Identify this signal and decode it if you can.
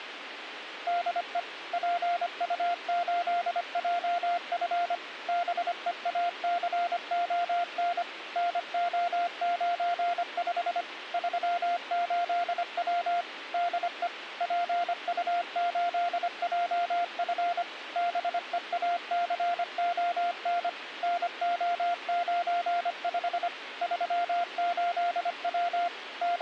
Morse code, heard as a keyed tone, machine-sent, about 25 wpm, 700 Hz, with radio hiss. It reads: DE PU8JF BEACON NO95 38W DE PU8JF BEACON NO95 38W …